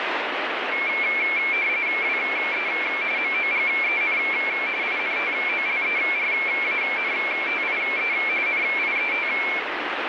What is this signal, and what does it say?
RTTY (45.45 baud, 170 Hz shift), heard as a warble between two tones, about 2250 Hz centre, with radio static. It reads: WE MOGEN INTOLERANTIE NIET